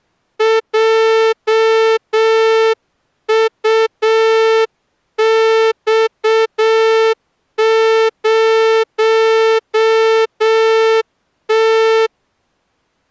Morse code, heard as a horn, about 7 wpm. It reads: JUX0T